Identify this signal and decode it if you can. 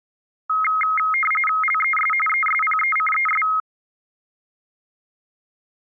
RTTY (45.45 baud, 850 Hz shift), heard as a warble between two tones, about 1700 Hz centre. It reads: LES ESPECES